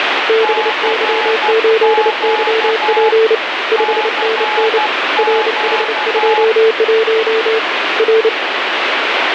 Morse code, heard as two keyed tones, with heavy radio static. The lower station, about 29 wpm, 440 Hz: BY8YP 5NN RH21 R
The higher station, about 12 wpm, 850 Hz: CQ CQ